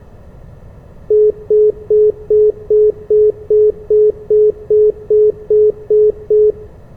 Telephone call progress tone (single-tone plan, as in most of Europe), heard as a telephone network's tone, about 420 Hz, 0.2 s on and 0.2 s off, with room echo. Congestion tone.